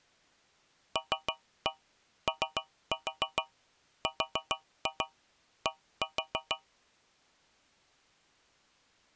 Tap code, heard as taps on a metal pipe, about 6 knocks a second. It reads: LORD